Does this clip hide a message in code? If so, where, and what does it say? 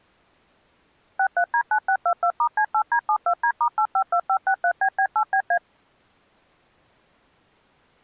Yes: DTMF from 1.2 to 5.6 s, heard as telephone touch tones, dialled by machine, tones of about 80 ms. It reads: 63D9622*C8D72D*852563BB8BA